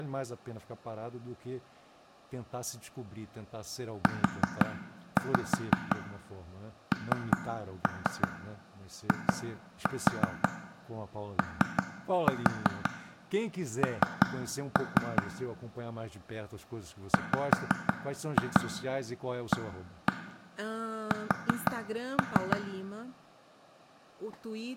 Tap code, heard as taps on a table, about 5 knocks a second, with room echo and speech in Portuguese. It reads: UNION WAS